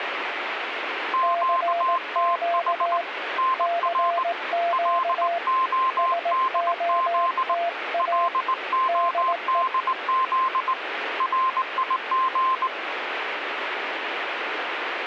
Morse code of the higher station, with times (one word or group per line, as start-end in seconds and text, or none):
1.1-3.0 QTH
3.4-4.2 NR
4.7-7.5 LODZ
8.0-10.7 LODZ
11.2-12.7 RIG